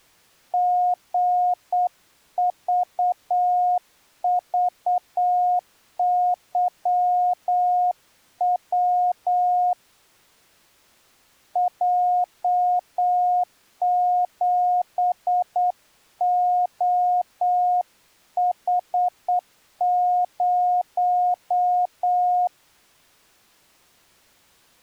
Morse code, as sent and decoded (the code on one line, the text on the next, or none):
--. ...- ...- -.-- .-- / .--- --... --- .... -----
GVVYW J7OH0